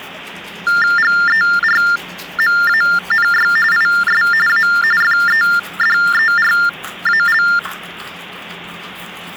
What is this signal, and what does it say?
TTY/TDD text telephone tones (45.45 baud Baudot), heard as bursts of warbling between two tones, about 400 Hz shift, 1600 Hz centre, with the noise of a restroom. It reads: GERMANY IS A FEDERAL